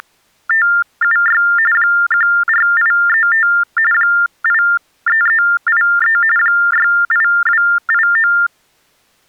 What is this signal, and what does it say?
TTY/TDD text telephone tones (45.45 baud Baudot), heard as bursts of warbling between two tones, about 400 Hz shift, 1600 Hz centre. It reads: … 14835 83383 68289